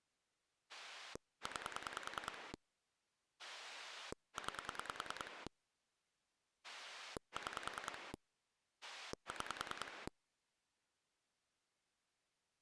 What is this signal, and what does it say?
Pulse dialling, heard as a rotary dial, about 10 pulses a second. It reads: 9 9 6 6